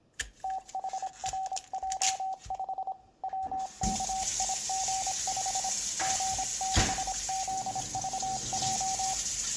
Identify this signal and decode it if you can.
Morse code, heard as a keyed tone, hand-sent with a paddle, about 26 wpm, 760 Hz, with room echo and kitchen noise. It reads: THRJ5 WKIG5 G6ZVJ